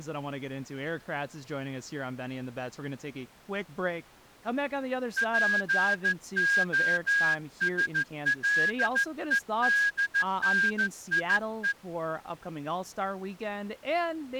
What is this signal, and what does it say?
Morse code (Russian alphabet), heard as a whistle, hand-sent with a straight key, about 14 wpm, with speech in English. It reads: ПОСЛЕДНИЕ